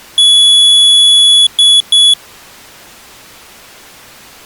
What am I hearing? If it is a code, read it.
Beep code, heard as a piezo beeper, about 3400 Hz. 1 long, 2 short. In Award, IBM and AMI BIOS tables: video adapter failure.